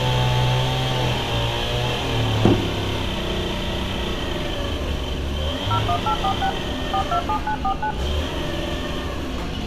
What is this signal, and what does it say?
DTMF, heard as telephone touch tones, dialled by machine, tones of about 80 ms, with room echo and street noise. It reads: 01846 427949